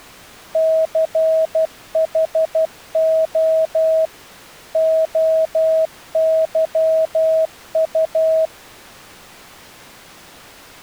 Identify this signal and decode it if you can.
Morse code, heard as a keyed tone, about 12 wpm, 640 Hz. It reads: CHO OYU